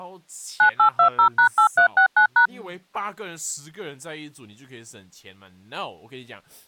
DTMF, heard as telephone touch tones, dialled by machine, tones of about 100 ms, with speech in Chinese. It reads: 9820#8369#